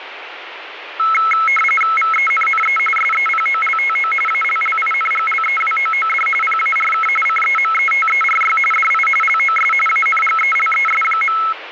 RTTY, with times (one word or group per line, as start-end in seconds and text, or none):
2.0-2.8 VENNE
3.0-4.1 SEPOLTO
4.3-6.3 ALLINGLEWOOD
6.4-7.1 PARK
7.3-8.6 CEMETERY
8.7-9.1 DI
9.2-9.7 LOS
9.9-11.4 ANGELES.